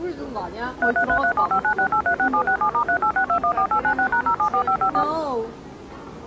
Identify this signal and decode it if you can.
DTMF, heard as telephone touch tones, dialled by machine, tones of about 80 ms, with the noise of a restaurant. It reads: 33337596836767*386214896#074554